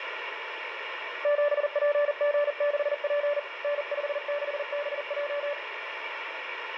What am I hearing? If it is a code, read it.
Morse code, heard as a keyed tone, hand-sent with a paddle, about 40 wpm, 580 Hz, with radio static and room echo. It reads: 7PG6P N56BJ